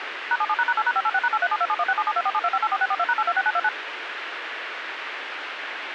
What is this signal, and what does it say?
DTMF, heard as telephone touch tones, dialled by machine, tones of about 50 ms, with radio hiss. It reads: #77##8#586#8372716772472584642#826929